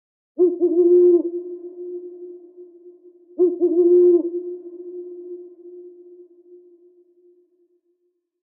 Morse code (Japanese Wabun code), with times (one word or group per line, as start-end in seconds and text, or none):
none